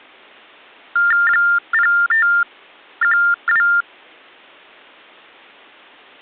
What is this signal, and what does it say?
TTY/TDD text telephone tones (45.45 baud Baudot), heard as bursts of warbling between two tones, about 400 Hz shift, 1600 Hz centre. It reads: 0512